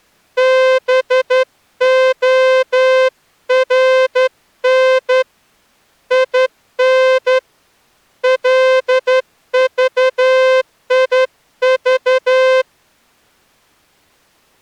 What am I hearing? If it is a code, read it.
Morse code, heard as a horn, hand-sent with a straight key, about 11 wpm. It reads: BORN IN LVIV